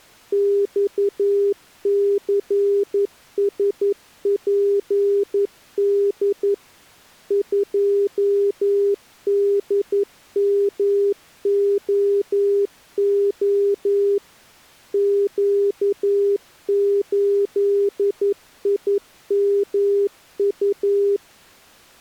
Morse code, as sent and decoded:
-..- -.-. ... .--. -.. / ..--- -.. -- --- --- / --.- ---.. .. -- ..-
XCSPD 2DMOO Q8IMU

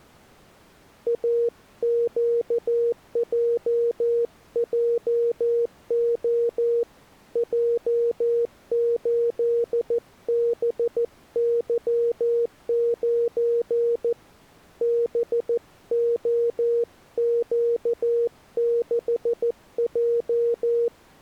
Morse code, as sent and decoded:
.- --.- .--- .--- --- / .--- ---.. -... -.-- ----. / -... --- --.- -.... .---
AQJJO J8BY9 BOQ6J

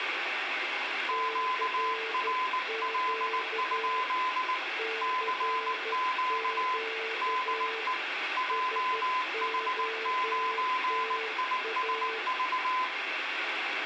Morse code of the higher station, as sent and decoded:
--.- .-. .-.. ..--.. / -.-. --.- / -.. . / .--- .... ----. .. ... ...-
QRL? CQ DE JH9ISV

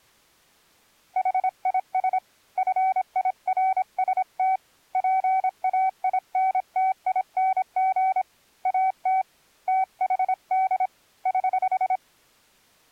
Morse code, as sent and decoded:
.... .. ... / ..-. .. .-. ... - / .--. .- .. -. - .. -. --. / .- - / - .... -.. / ........
HIS FIRST PAINTING AT THD <HH>

